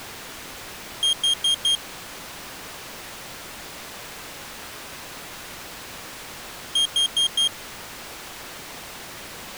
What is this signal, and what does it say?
Alarm pattern, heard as an alarm's beeps, played twice, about 3200 Hz. Temporal four. Carbon monoxide.